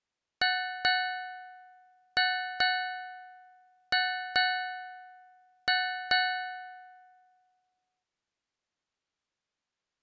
Ship's bell, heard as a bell. 8. Eight half-hours of the watch have passed.